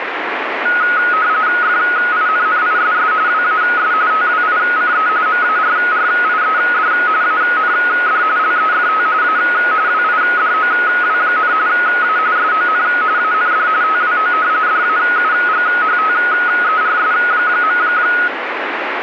RTTY (45.45 baud, 170 Hz shift), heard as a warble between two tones, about 1360 Hz centre, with radio static. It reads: FINNISS WAS TWICE MARRIED AND LEFT A WIDOW, A SON AND TWO DAUGHTERS.